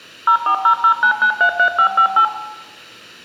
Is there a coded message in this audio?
Yes: DTMF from 0.3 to 2.2 s, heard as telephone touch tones, dialled by machine, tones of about 90 ms, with room echo. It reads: 04009933558